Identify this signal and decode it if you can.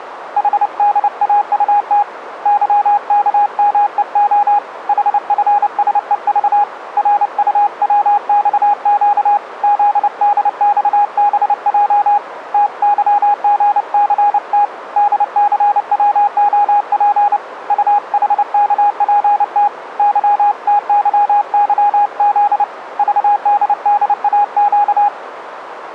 Morse code, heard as a keyed tone, hand-sent with a paddle, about 29 wpm, 820 Hz, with radio static. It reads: HDAUT YKMEO HFSEV RUWXQ ZDXBJ TYGCT DCWOP UHKPT YTYYZ VDDAQ